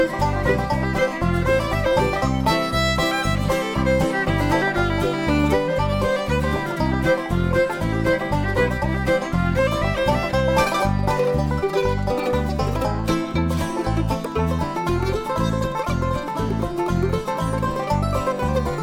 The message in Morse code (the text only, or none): none